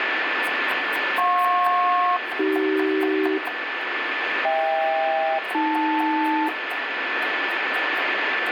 Aircraft SELCAL, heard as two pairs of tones, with radio static, a steady whistle near 1750 Hz and kitchen noise. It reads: JP-AC HK-AL